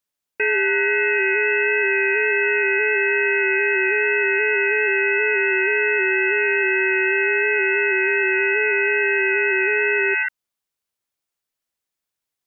FT8 (several signals at once), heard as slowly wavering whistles, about 6.25 baud.